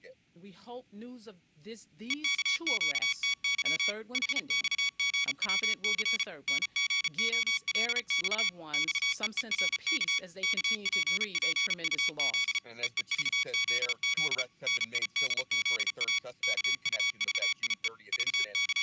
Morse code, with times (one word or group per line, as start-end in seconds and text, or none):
2.1-3.9 EKQTY
4.1-6.2 HXGWC
6.5-8.5 NGOLX
8.7-10.2 XEERK
10.4-12.6 KPPUZ
12.8-14.4 EEVZZ
14.7-16.2 NIDZA
16.4-17.9 KUVIE
18.1-18.8 …